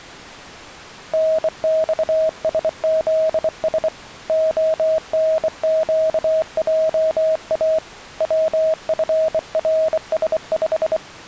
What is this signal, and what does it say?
Morse code, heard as a keyed tone, hand-sent with a bug key, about 24 wpm, 640 Hz. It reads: NXSZS ONQJA WFRS5